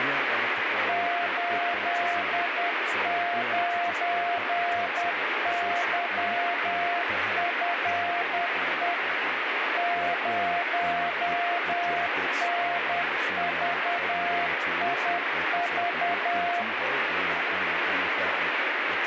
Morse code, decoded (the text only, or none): 89YFE 0NVIV